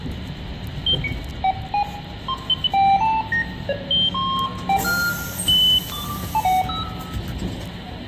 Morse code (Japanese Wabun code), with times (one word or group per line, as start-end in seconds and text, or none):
none